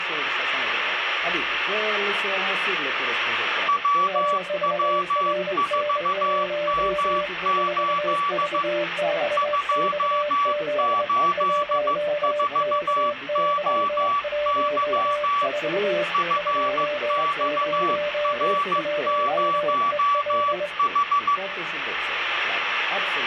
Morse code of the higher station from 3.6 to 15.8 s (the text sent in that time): WW4M8 284OY